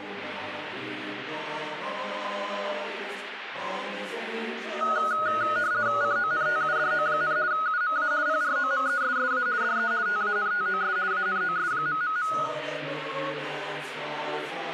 RTTY (50 baud, 170 Hz shift), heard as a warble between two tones, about 1360 Hz centre. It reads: CONTUDO, UMA PROMESSA DE TANTOS ANOS...